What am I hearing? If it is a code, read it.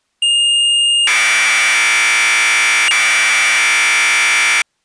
Commodore tape loading (standard loader), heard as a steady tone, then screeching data.